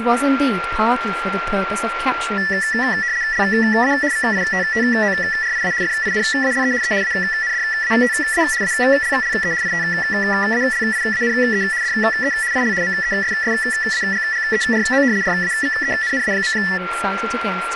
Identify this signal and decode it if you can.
RTTY (75 baud, 170 Hz shift), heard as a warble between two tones, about 1850 Hz centre, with radio static, a steady whistle near 1380 Hz and speech in English. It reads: LA VITTORIA FINALE E ANDATA ALLE ITALIANE DE IL MESSAGGERO RAVENNA.